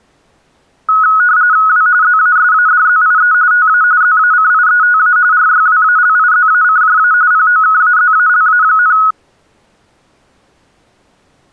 RTTY (45.45 baud, 170 Hz shift), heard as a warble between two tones, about 1370 Hz centre. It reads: W ZASADZIE TA ZACIETA RYWALIZACJA POKAZALA,